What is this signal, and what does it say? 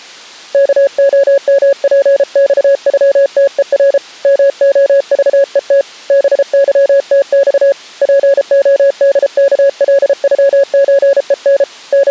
Morse code (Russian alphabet), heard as a keyed tone, hand-sent with a paddle, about 33 wpm, 560 Hz. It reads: КОМПЬЮТЕР МОЖЕТ БЫТЬ ПОДКЛЮЧЕН …